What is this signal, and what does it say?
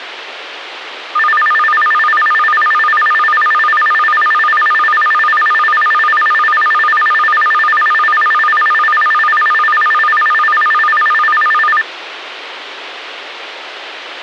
A tone that alternates evenly between two pitches, with radio hiss. There is no code.